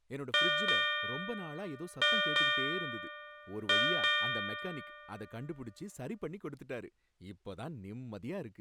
Ship's bell, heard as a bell, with speech in Tamil. 6. Six half-hours of the watch have passed.